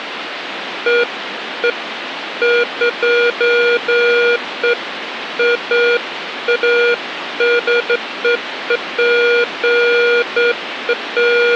Beeps of irregular length, with phone line noise. There is no code.